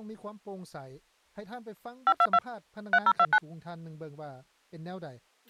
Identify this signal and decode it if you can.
DTMF, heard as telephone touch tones, dialled by machine, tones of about 60 ms. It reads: 522 3029